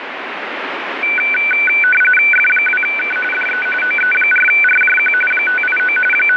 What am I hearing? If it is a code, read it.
RTTY (45.45 baud, 850 Hz shift), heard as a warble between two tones, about 1900 Hz centre, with radio static. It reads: F2K DE OE4RJQ 589 …